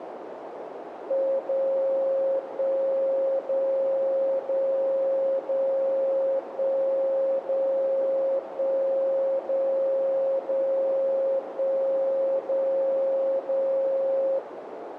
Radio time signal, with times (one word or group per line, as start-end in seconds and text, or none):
1.4-2.4 0
2.4-3.4 1
3.4-4.4 0
4.4-5.4 0
5.4-6.4 0
6.4-7.4 1
7.4-8.4 0
8.4-9.4 1
9.4-10.4 0
10.4-11.4 0
11.4-12.4 1
12.4-13.4 0
13.4-14.4 0